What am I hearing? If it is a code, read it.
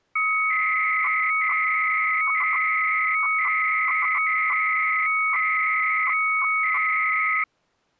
300-baud modem data (Bell 103 tones), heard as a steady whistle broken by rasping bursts, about 300 baud, 200 Hz shift.